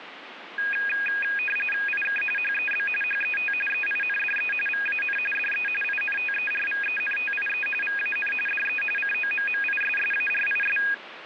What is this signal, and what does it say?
RTTY (45.45 baud, 850 Hz shift), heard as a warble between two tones, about 2050 Hz centre, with radio static. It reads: IK HEB HET EINDE VAN DE INTERVENTIE VAN DE COMMISSARIS